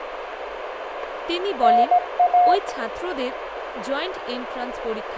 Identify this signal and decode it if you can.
Morse code (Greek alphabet), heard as a keyed tone, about 17 wpm, 720 Hz, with radio static, a narrow filter and speech in Bangla. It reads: ΝΑ